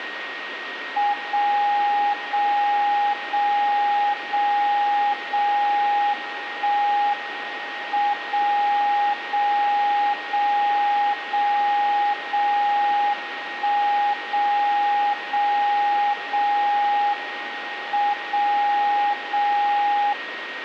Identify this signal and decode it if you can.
Radio time signal (WWVB), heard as a tone whose level steps once a second, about 820 Hz, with radio static and a steady whistle near 1870 Hz. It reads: 0 0 0 0 0 1 M 0 0 0 0 0 1 0 0 0 M 0 0